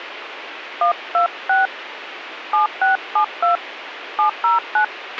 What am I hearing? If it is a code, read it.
DTMF, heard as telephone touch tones, dialled by hand, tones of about 130 ms, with radio hiss and a squelch burst at the end. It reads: 126 7672 709